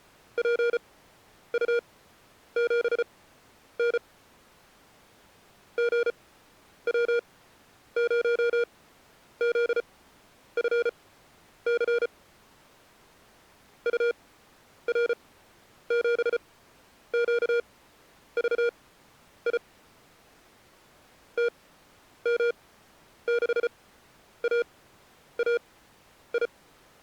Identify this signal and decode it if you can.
Morse code, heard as electronic beeps, machine-sent, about 34 wpm, spaced as for 10 wpm, 470 Hz. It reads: PU7N GW0ZFC UR7QVI TM6AAI